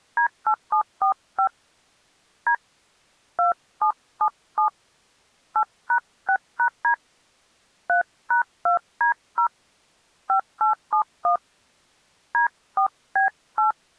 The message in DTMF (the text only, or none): D8745 D 2777 8#6#D 3#2D0 5871 D4B8